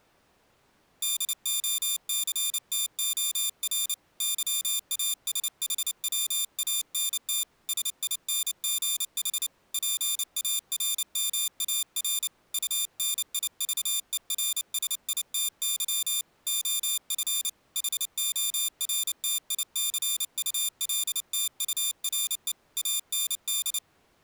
Morse code, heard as a high beeper, hand-sent with a paddle, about 29 wpm, 3600 Hz. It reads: DOCTOR YASHWANT SINGH PARMAR UNIVERSITY OF HORTICULTURE AND